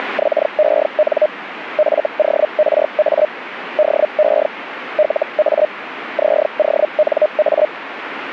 Hellschreiber (Feld-Hell, 122.5 baud), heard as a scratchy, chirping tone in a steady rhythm, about 610 Hz, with radio static. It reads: … FORA DE LA ZONA